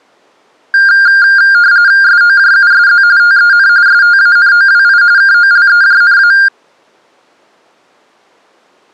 RTTY (45.45 baud, 170 Hz shift), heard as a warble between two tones, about 1500 Hz centre. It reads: SOJUSZ TEN STANOWI KOLEJNA